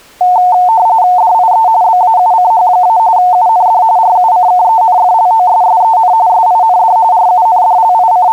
RTTY (45.45 baud, 170 Hz shift), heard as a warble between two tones, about 810 Hz centre. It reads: DIE BAUCH- UND RUCKENFLOSSEN SIND …